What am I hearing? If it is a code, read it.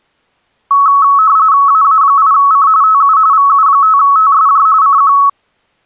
RTTY (45.45 baud, 170 Hz shift), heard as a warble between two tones, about 1200 Hz centre. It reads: AA8C TU VU5TSJ CQ